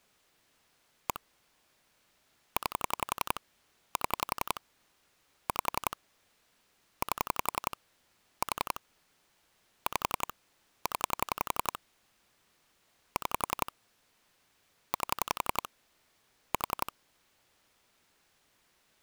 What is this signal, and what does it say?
Pulse dialling, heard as clicks on a phone line, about 11 pulses a second. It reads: 1 9 7 5 8 4 5 0 6 8 4